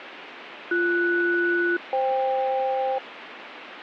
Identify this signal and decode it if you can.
Aircraft SELCAL, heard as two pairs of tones, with radio static. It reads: BS-FK